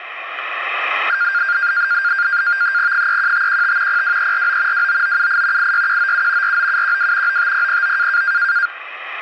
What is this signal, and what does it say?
NAVTEX (SITOR-B), 100 baud, 170 Hz shift, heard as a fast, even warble, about 1500 Hz centre. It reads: 31515 02349 29978 86197 49712 95009